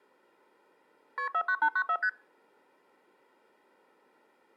Multi-frequency trunk signalling (R1, as on North American trunks), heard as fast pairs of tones, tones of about 70 ms. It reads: KP 49894 ST